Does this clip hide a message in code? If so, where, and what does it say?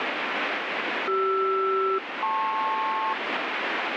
Yes: aircraft SELCAL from 1.1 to 3.1 s, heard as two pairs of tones, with heavy radio static. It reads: CR-LP